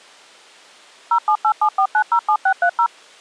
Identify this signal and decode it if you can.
DTMF, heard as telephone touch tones, dialled by machine, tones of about 80 ms. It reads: 07874907630